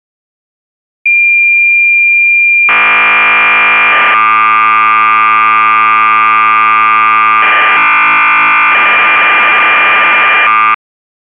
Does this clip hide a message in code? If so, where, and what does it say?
Yes: cassette data (Kansas City type), 1200 baud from 1.1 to 10.7 s, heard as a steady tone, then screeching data.